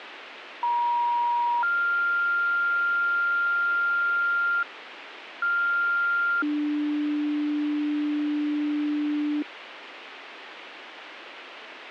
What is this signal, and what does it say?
Two-tone page, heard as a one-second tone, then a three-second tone, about 950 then 1400 Hz, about 1400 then 300 Hz, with radio hiss.